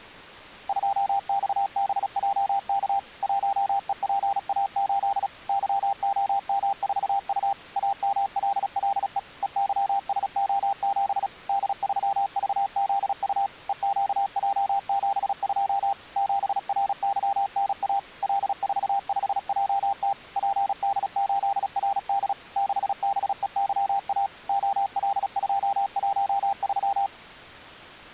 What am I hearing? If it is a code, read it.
Morse code, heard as a keyed tone, machine-sent, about 36 wpm, 800 Hz. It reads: 2XBJK 1EPA8 YOM4U AMLLE EYSO7 D3VZU EQJ72 7RYNA L45JT PD8RD 6BEYA OL213